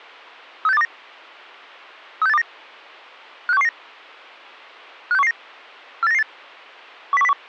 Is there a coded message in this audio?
Yes: five-tone selective call (EEA) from 0.6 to 7.3 s, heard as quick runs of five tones, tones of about 40 ms. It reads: 36829 36829 56119 56119 48998 10101